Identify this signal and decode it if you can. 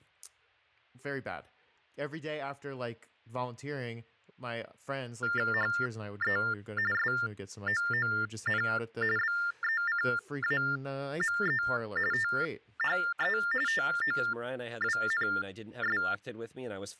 TTY/TDD text telephone tones (45.45 baud Baudot), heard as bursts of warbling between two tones, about 400 Hz shift, 1600 Hz centre, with speech in English. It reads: HE SOON BECAME THE TOWNS